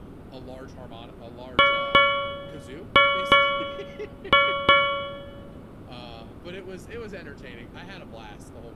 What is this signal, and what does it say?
Ship's bell, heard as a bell, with room echo and speech in English. 6. Six half-hours of the watch have passed.